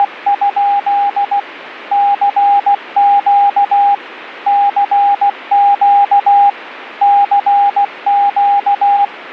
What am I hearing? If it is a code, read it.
Morse code, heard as a keyed tone, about 16 wpm, 810 Hz, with radio static. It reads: … CQ CQ CQ